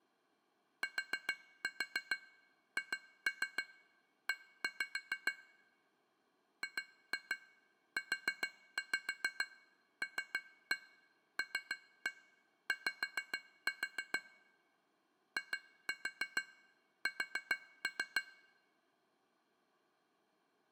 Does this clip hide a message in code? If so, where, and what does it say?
Yes: tap code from 0.8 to 18.3 s, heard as taps on glass, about 6 knocks a second. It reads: THE GULLY IS